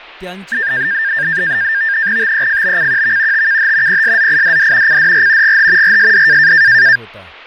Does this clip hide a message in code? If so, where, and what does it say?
Yes: NAVTEX (SITOR-B), 100 baud, 170 Hz shift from 0.5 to 7.0 s, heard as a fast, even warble, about 1700 Hz centre, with fading and speech in Marathi. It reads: TEFBCQV TKH PSZIDD CDR GH RSD